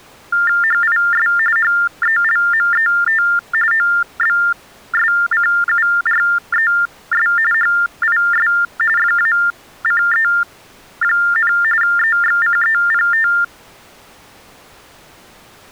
TTY/TDD text telephone tones (45.45 baud Baudot), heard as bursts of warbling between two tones, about 400 Hz shift, 1600 Hz centre. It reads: HIS HELMET OBSCURES HIS FACE, EXCEPT